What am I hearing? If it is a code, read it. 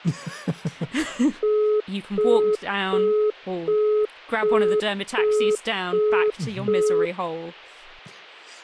Telephone call progress tone (as in the UK, Australia and similar networks), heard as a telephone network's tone, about 420 Hz, 0.375 s on and 0.375 s off, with speech in English. Busy tone.